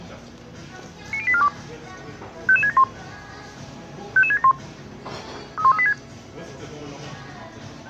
Five-tone selective call (ZVEI), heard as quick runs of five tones, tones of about 70 ms, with the noise of a crowd indoors. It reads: 90842 55671 55671 31386